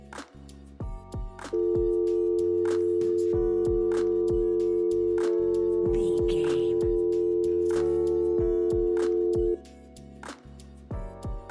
Telephone call progress tone (North American or UK plan), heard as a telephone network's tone, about 350, 440 Hz. Dial tone.